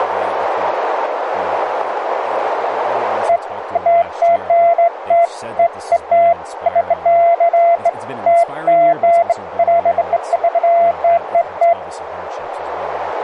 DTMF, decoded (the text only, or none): none